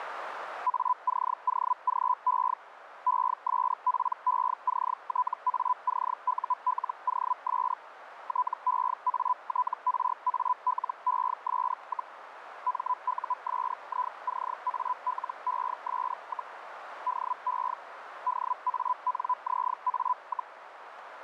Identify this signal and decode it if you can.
Hellschreiber (Feld-Hell, 122.5 baud), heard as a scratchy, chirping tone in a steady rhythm, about 1000 Hz, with radio static and a narrow filter. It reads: ACOGE ESPECTACULOS TEATRALES, MUSICALES, DE DANZA,